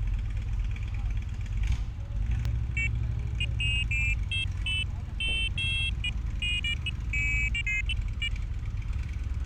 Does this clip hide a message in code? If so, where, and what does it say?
No, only pairs of high tones at irregular times, with street noise.